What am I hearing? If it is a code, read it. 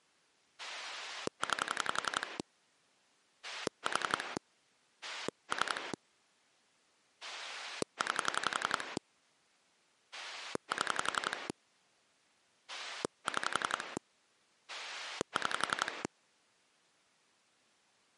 Pulse dialling, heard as a rotary dial, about 11 pulses a second. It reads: 9 4 3 9 7 6 6